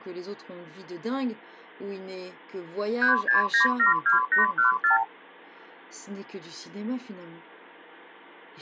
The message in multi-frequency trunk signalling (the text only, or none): 36972814